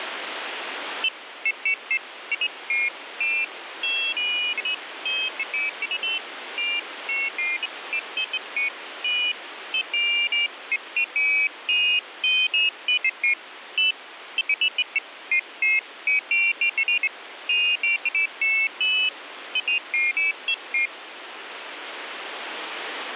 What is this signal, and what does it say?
Pairs of high tones at irregular times, with radio static. There is no code.